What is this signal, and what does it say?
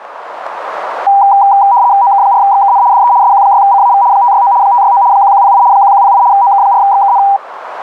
RTTY (75 baud, 170 Hz shift), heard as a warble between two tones, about 880 Hz centre, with radio static. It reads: OK4XKN DE SQ6CAV 569 569 1108 1108 OK4XKN